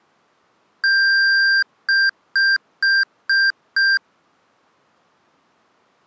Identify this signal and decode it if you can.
Beep code, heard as beeps from a small speaker, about 1600 Hz. 1 long, 5 short.